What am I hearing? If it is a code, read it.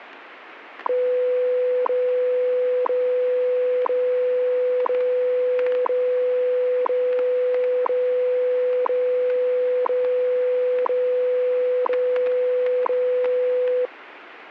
Radio time signal (WWV, Colorado), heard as ticks, one a second, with radio static and static crashes.